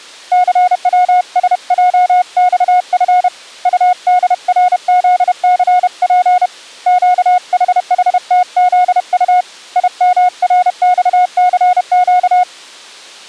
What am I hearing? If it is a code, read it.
Morse code, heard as a keyed tone, hand-sent with a paddle, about 31 wpm, 720 Hz. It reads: CWSJXF UDRZCP QHHTZU IMRXCQ